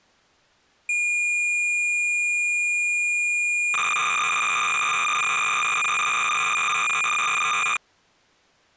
Cassette data (Kansas City type), 300 baud, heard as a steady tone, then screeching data.